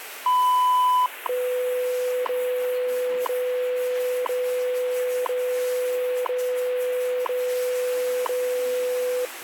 Radio time signal (WWV, Colorado), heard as ticks, one a second, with radio static and the noise of a restroom.